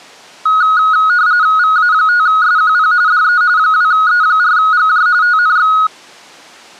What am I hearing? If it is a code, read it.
RTTY (45.45 baud, 170 Hz shift), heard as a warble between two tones, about 1360 Hz centre. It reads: VA5SQP DE 2E4GJ TNX